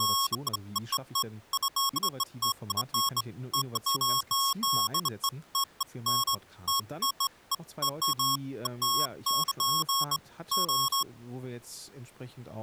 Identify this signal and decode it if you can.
Beeps of irregular length, with speech in German. There is no code.